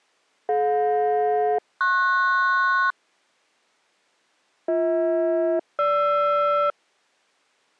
Aircraft SELCAL, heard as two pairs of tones. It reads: DJ-PS BH-GR